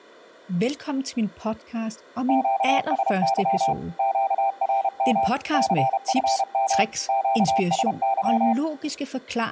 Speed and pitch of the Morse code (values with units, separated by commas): 31 wpm, 790 Hz